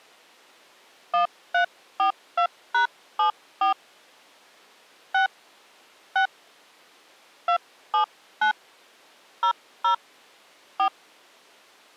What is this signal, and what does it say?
DTMF, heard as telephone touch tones, dialled by hand, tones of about 100 ms. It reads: 1342#74 6 6 279 00 4